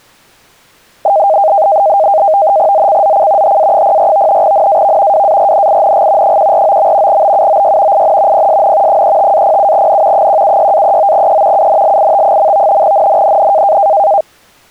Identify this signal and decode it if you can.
NAVTEX (SITOR-B), 100 baud, 170 Hz shift, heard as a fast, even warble, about 710 Hz centre. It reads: ZCZC HA04 NAV WARNING 149. BUOY IN PSN 35-07N 176-39E UNLIT. NNNN